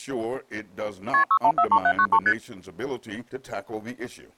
Multi-frequency trunk signalling (R1, as on North American trunks), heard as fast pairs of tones, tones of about 70 ms. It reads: KP 6143793 ST